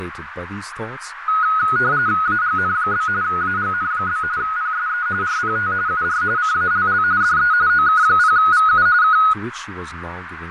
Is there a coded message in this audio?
Yes: RTTY (45.45 baud, 170 Hz shift) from 1.3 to 9.3 s, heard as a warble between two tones, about 1360 Hz centre, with radio static, fading, a narrow filter and speech in English. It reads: AGN? AGN? PSE RPT UR CALL DE OK0VU K